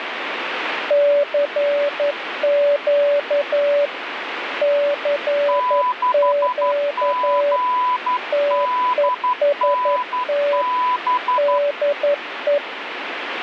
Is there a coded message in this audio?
Yes: Morse code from 0.8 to 12.6 s, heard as two keyed tones, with radio static. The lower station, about 11 wpm, 580 Hz: CQ CQ TEST DE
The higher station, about 12 wpm, 1000 Hz: 6GDNB